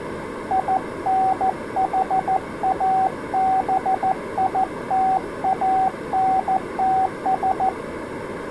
Morse code, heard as a keyed tone, hand-sent with a paddle, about 14 wpm, 760 Hz. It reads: INHABITANTS